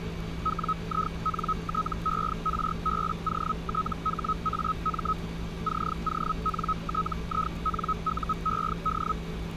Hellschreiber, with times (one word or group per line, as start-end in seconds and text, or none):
0.4-5.1 WINTERBOTHAM
5.6-9.1 CONTINUED